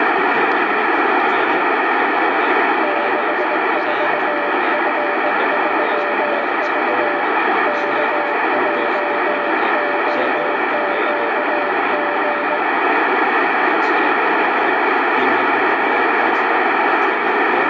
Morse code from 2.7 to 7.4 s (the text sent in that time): 64F3V